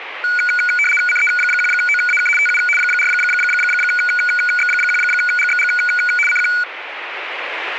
RTTY (75 baud, 850 Hz shift), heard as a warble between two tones, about 1900 Hz centre, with radio static. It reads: CE1OAK TU 4X1GXG CQ